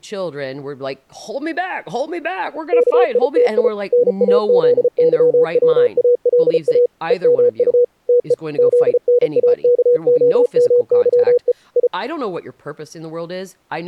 Morse code (Russian alphabet), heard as a keyed tone, machine-sent, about 34 wpm, 490 Hz, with speech in English. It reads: КИТИ НАЗЫВАЛА ЕМУ ТЕ ЗНАКОМЫЕ И